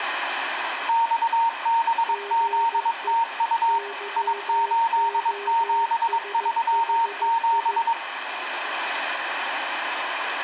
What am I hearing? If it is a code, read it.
Morse code, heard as two keyed tones, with radio static. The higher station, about 22 wpm, 920 Hz: XBZTU I8737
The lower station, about 15 wpm, 400 Hz: GE YOSHI